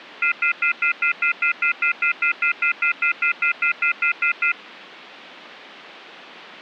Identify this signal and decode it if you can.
Telephone call progress tone (North American plan), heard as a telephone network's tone, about 1400, 2050, 2450, 2600 Hz, 0.1 s on and 0.1 s off. Off-hook warning tone.